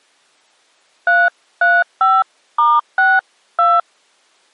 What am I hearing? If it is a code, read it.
DTMF, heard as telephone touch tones, dialled by hand, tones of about 210 ms. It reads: 335*62